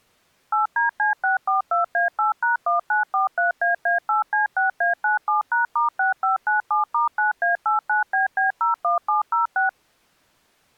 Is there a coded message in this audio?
Yes: DTMF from 0.5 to 9.7 s, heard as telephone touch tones, dialled by machine, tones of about 130 ms. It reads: 8DC642A8#1943AA8C6A97#*6597*9A89BB01706